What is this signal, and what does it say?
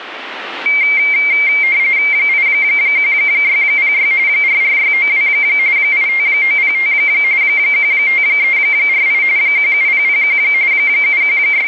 RTTY (45.45 baud, 170 Hz shift), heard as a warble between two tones, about 2200 Hz centre. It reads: 81606 44692 85905 15348 17001 …